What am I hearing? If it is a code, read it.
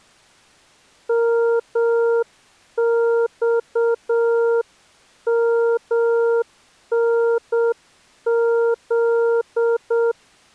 Morse code, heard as a keyed tone, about 7 wpm, 460 Hz. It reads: MXMNZ